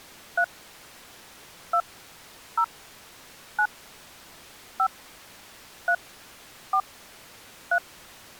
DTMF, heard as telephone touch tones, dialled by hand, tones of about 70 ms. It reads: 3 2 0 9 5 3 4 3